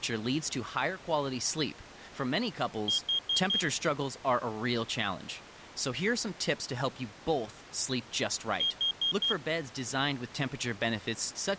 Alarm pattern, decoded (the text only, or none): temporal four